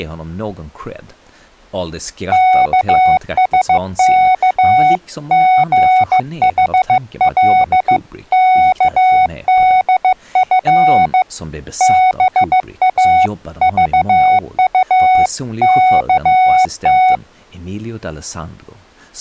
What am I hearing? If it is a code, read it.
Morse code (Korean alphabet), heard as a keyed tone, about 15 wpm, 740 Hz, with speech in English. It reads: 영숙은 도리어